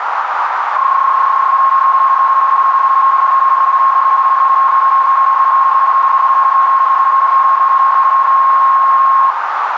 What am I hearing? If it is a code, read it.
PSK31 (31.25 baud), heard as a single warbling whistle, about 1080 Hz, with radio static and a narrow filter.